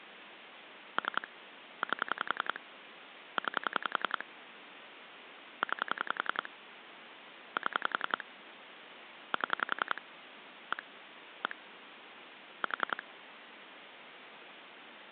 Pulse dialling, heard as clicks on a phone line, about 10 pulses a second, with phone line noise. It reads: 3 8 9 9 7 7 1 1 4